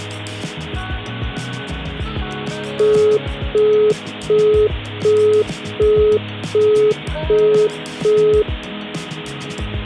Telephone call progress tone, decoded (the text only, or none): busy tone